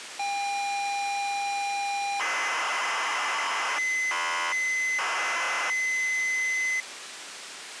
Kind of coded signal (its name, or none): ZX Spectrum tape loading